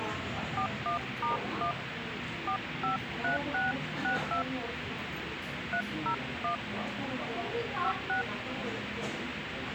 DTMF, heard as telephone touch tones, dialled by hand, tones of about 120 ms, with radio hiss and the noise of a cafe. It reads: 41*1 453662 301 56